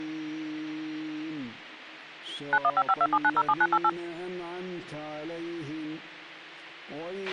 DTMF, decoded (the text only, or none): 915527907988